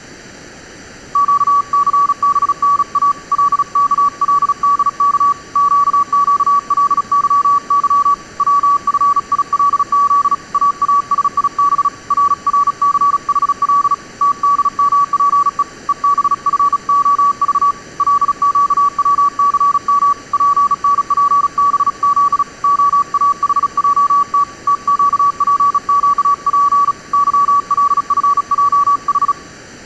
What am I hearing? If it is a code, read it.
Morse code, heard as a keyed tone, hand-sent with a bug key, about 36 wpm, 1140 Hz. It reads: QCBNA LKLDK QQLYY WFILZ AASIB RRCHL TDMPE EBFOV LQWCM PNPBZ OAHJT TQPQP YLFJH